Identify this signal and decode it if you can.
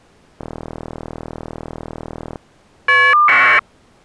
Caller ID data burst, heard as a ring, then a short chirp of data, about 1200 baud.